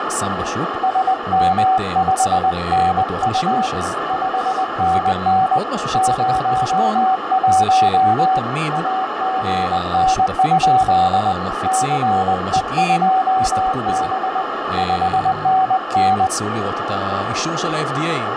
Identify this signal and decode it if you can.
Morse code, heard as a keyed tone, hand-sent with a paddle, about 20 wpm, 760 Hz, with heavy radio static, a narrow filter and speech in Hebrew. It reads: SM5NU 5NN 01 AGN? CE2B 5NN